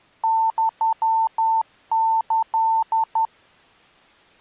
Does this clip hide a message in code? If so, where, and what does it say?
Yes: Morse code (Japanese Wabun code) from 0.2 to 3.3 s, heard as a keyed tone, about 12 wpm, 900 Hz. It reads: ユキ